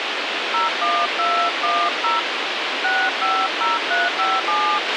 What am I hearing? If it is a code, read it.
DTMF, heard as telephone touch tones, dialled by hand, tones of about 230 ms, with radio hiss and a squelch burst at the end. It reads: 01210 650357